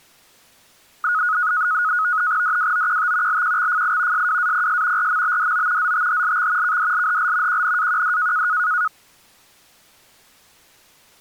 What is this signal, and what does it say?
NAVTEX (SITOR-B), 100 baud, 170 Hz shift, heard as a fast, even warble, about 1360 Hz centre. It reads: DWOQT LQXFI SWAPS RMBDO ZTHLX KDLHL QNAQD